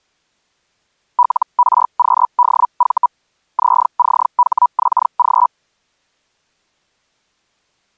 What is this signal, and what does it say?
Hellschreiber (Feld-Hell, 122.5 baud), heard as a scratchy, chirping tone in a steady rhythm, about 980 Hz. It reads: LRQDV ZCHXG